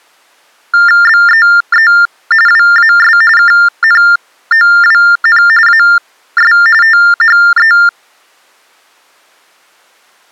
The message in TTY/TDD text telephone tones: BEE WAS KNOWN AS THE

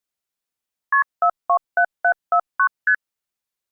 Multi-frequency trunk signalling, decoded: KP 427749 ST

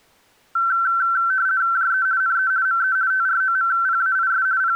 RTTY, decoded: JE NE ME TROMPAIS …

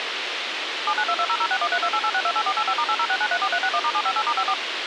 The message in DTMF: 792200613288628485*806934361*758*54

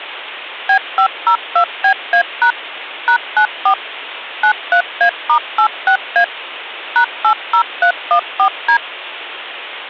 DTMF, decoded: B502BA# #94 93A*86A #80314D

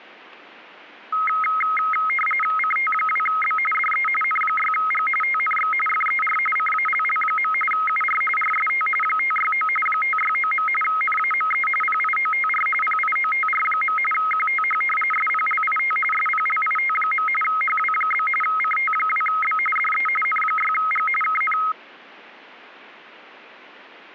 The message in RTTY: CT2B DE N6G TNX FER CALL. UR RST 569 569. NAME PIOTR PIOTR. QTH SPLIT SPLIT. HW? CT2B DE N6G KN

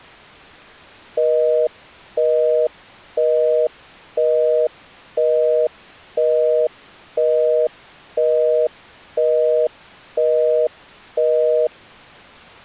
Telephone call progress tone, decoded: busy tone

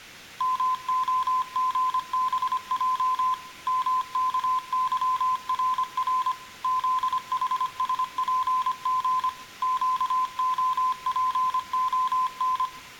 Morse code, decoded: MOGBJ MKYRR ZHSPG QOPON

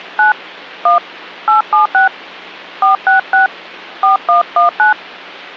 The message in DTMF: 9 1 876 466 4119

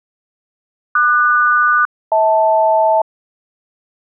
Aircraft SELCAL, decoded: QS-HL

